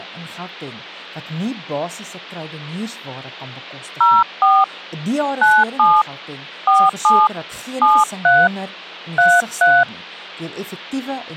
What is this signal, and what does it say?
DTMF, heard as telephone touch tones, dialled by hand, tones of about 220 ms, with hum. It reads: 04 97 47 73 33